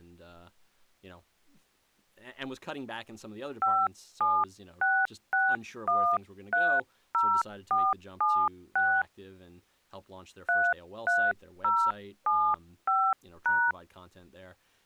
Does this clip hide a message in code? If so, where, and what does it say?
Yes: DTMF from 3.6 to 13.7 s, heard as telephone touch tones, dialled by hand, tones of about 260 ms, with speech in English. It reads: 5766130476 33075#